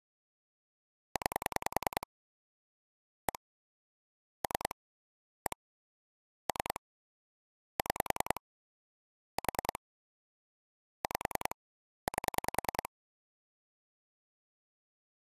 Pulse dialling, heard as clicks on a phone line, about 10 pulses a second. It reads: 9 1 3 1 3 6 4 5 8